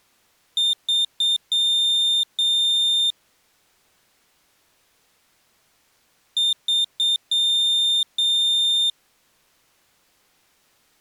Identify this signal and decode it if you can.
Beep code, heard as a piezo beeper, played twice, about 3600 Hz. 3 short, 2 long.